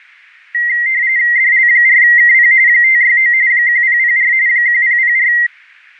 RTTY (45.45 baud, 170 Hz shift), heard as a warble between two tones, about 2000 Hz centre. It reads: DL4KP 569 1004 1004